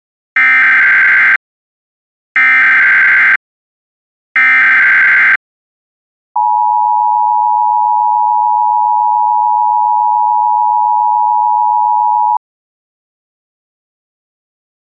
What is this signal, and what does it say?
Emergency Alert System (SAME) tones (header bursts, then the 853 and 960 Hz attention tone), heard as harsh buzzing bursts, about 520.83 baud.